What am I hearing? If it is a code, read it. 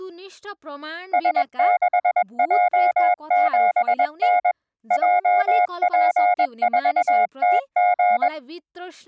Morse code, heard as a keyed tone, machine-sent, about 21 wpm, 720 Hz, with speech in Nepali. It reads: S6J7N JP4TG